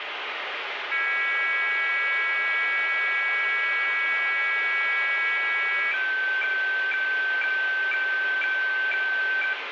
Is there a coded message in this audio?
Yes: weather fax (radiofax), 120 lines a minute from 0.9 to 9.5 s, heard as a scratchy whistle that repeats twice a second, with radio static and room echo.